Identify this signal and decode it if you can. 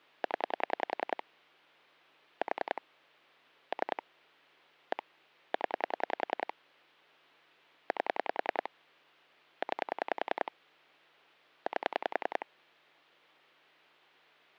Pulse dialling, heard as clicks on a phone line, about 10 pulses a second, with hum. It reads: 0 4 3 1 0 8 9 8